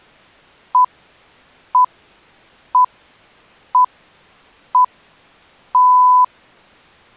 Radio time signal (six pips, as the Greenwich Time Signal), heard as pips.